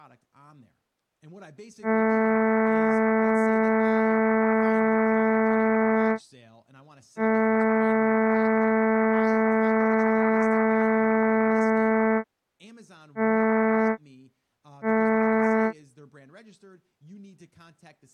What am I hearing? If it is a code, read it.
Ship horn signal, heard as a ship's horn, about 220 Hz, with speech in English. 2 long, 2 short. At sea: I intend to overtake on your port side.